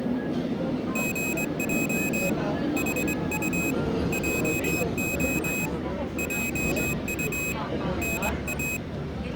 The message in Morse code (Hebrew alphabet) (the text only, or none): גע חט עה עט נא